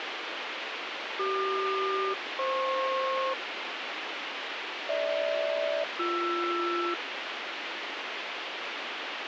Aircraft SELCAL, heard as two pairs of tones, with radio hiss. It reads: CQ-FP GH-BR